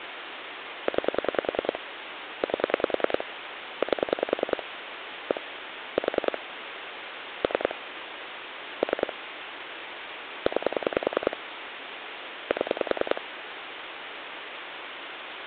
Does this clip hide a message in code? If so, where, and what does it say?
Yes: pulse dialling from 0.9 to 13.2 s, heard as clicks on a phone line, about 10 pulses a second, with phone line noise. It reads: 9 8 8 1 4 3 3 9 7